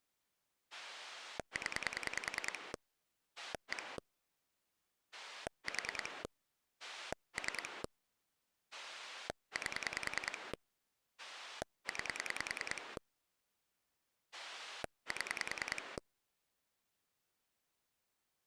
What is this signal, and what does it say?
Pulse dialling, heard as a rotary dial, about 10 pulses a second. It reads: 0 1 4 3 8 9 7